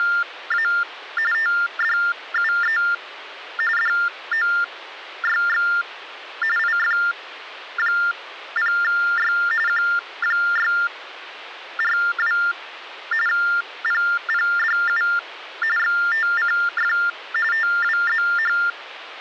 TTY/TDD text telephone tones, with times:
0.0-0.7 …
1.3-2.8 TDUE
3.8-5.7 DOYX
6.6-9.3 IF0Y
9.7-12.4 Q642
13.3-15.0 PPDU
15.8-16.9 XTCF
17.5-18.6 TWZH

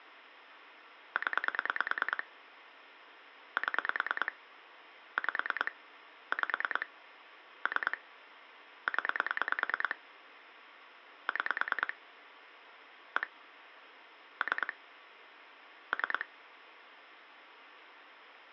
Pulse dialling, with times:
1.2-2.2 0
3.6-4.3 7
5.2-5.7 5
6.3-6.9 5
7.7-8.0 3
8.9-10.0 0
11.3-11.9 6
13.2-13.3 1
14.4-14.7 3
15.9-16.3 3

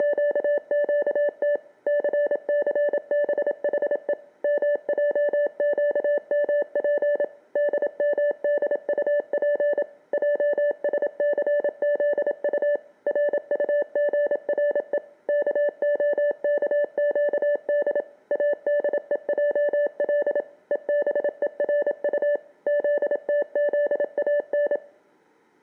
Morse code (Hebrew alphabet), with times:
0.0-1.6 …
1.9-4.1 ססבחו
4.4-7.2 מעקמף
7.6-9.8 דמדטף
10.1-12.8 עשסזט
13.1-15.0 רטגרו
15.3-18.0 כהכקד
18.3-20.4 אדועל
20.7-22.4 ובורט
22.7-24.8 זתזאן

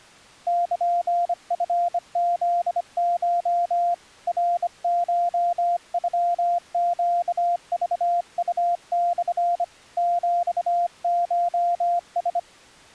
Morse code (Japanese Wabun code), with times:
0.5-3.9 ルチフコ
4.3-9.6 ナコノネクウモ
10.0-12.4 ヒコラ

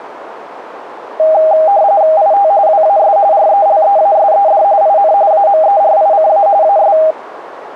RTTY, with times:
2.2-2.5 IT
2.7-3.2 WAS
3.3-4.6 RELEASED
4.8-5.1 IN
5.3-6.5 AMERICA
6.6-7.0 AS

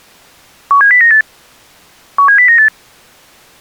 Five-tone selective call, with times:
0.7-1.2 17098
2.2-2.7 17098

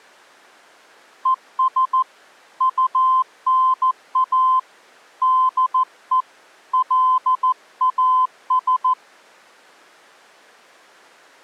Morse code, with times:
1.3-2.0 ES
2.6-4.6 UNA
5.2-6.2 DE
6.7-8.9 LAS

